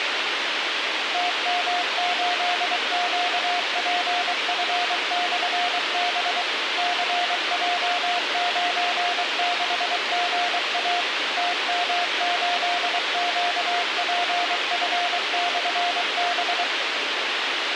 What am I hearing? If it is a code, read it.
Morse code, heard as a keyed tone, machine-sent, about 23 wpm, 710 Hz, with radio hiss. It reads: TM8QPF/B CJ96GA TM8QPF/B